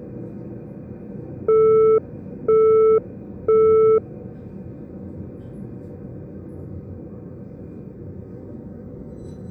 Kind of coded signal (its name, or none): telephone call progress tone